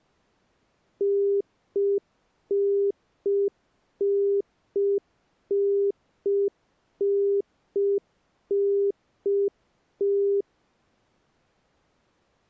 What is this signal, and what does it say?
Telephone call progress tone (UK plan), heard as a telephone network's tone, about 400 Hz. Congestion tone.